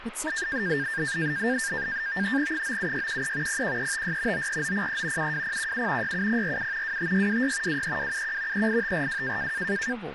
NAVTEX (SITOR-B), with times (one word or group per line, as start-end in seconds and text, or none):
2.5-3.6 97613
3.5-4.5 01356
4.3-5.3 94903
5.2-6.1 72017
6.0-7.0 67047
6.8-7.8 25626
7.7-8.7 23271
8.5-9.5 38542